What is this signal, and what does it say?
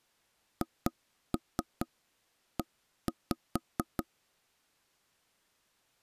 Tap code, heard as knocks on wood, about 4 knocks a second. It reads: HE